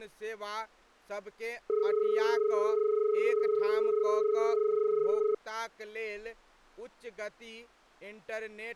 Telephone call progress tone (as in Australia), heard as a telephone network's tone, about 430 Hz, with speech in Maithili. Dial tone.